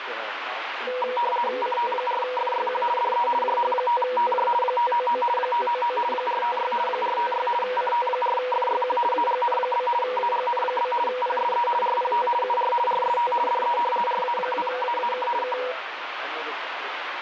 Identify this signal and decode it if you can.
RTTY (50 baud, 450 Hz shift), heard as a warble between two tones, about 730 Hz centre, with radio static. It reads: CT4FYQ DE JH5TJ 599 599 456 456 CT4FYQ AGN? AGN? PSE RPT UR RST DE RA2AAK K